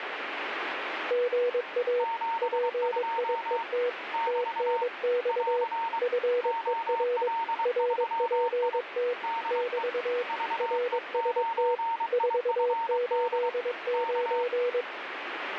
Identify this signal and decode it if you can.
Morse code, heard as two keyed tones, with radio static. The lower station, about 22 wpm, 490 Hz: GA PIET TNX FER RPT <BT> RST 489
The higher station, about 23 wpm, 920 Hz: 72 <BT> <AR> OL3I DE VE9IFD K